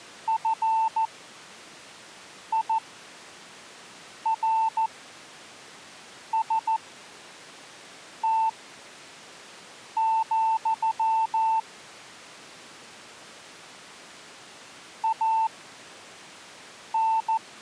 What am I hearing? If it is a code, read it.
Morse code, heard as a keyed tone, machine-sent, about 14 wpm, spaced as for 5 wpm, 890 Hz. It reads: FIRST, AN